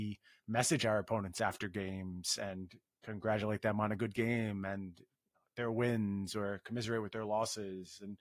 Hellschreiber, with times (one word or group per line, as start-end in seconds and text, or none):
none